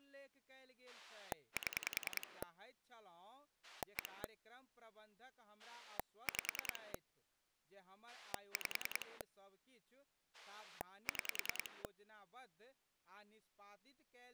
Pulse dialling, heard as a rotary dial, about 10 pulses a second, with speech in Maithili. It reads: 7 1 5 5 6